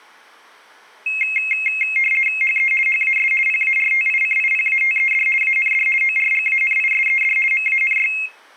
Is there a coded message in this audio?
Yes: RTTY (50 baud, 450 Hz shift) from 1.1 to 8.3 s, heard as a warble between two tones, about 2350 Hz centre. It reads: HE HAS PARTICIPATED AND ORGANISED MANY